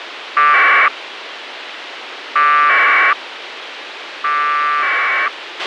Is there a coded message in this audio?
Yes: packet radio (AX.25, as in APRS), 1200 baud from 0.4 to 5.3 s, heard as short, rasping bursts, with radio hiss and a squelch burst at the end.